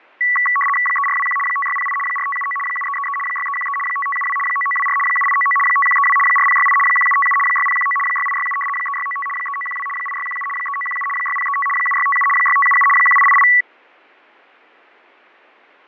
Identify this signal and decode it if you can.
RTTY (75 baud, 850 Hz shift), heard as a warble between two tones, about 1550 Hz centre, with fading. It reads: 3421 5608 4579 7333 6313 5572 9924 7899 5132 4068 1757 6019 6867 3695 3912 8617 3917 6035 7657 6577 1888